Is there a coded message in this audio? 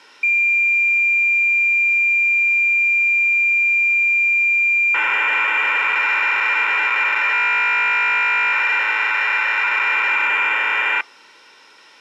Yes: cassette data (Kansas City type), 1200 baud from 0.2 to 11.0 s, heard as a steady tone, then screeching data.